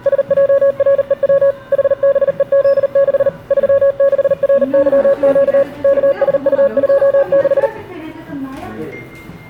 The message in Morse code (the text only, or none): SJREW HBEZ6 36RYQ KSU26